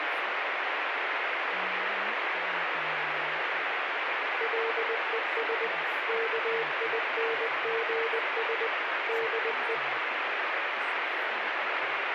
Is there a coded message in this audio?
Yes: Morse code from 4.3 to 9.8 s, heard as a keyed tone, machine-sent, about 20 wpm, 460 Hz, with heavy radio static. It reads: LES KINGS DE